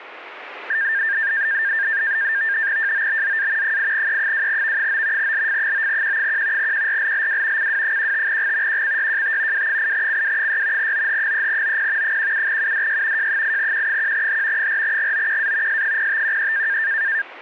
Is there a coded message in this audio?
Yes: NAVTEX (SITOR-B), 100 baud, 170 Hz shift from 0.7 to 17.2 s, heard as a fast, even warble, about 1700 Hz centre. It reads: JOBZA 8E2V9 LF9Q1 QRLLW CW15G QCYJT W8CW6 OH3OP 17UDY J8Q1H 4GOQA S0513